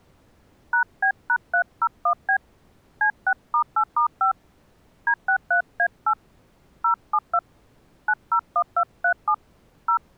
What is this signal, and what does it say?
DTMF, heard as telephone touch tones, dialled by hand, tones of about 80 ms. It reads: #B#301B C6*8*5 D63A8 072 901237 0